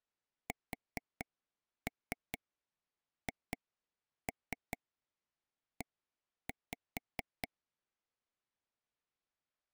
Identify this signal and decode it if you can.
Tap code, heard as taps on a table, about 4 knocks a second. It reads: SHE